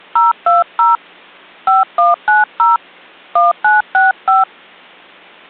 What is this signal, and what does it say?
DTMF, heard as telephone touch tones, dialled by hand, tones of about 160 ms. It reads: 020 5190 1965